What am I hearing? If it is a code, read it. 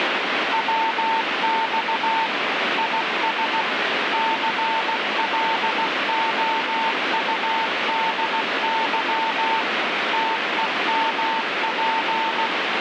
Morse code, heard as a keyed tone, machine-sent, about 16 wpm, 900 Hz, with heavy radio static. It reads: WX IS CLOUDY TEMP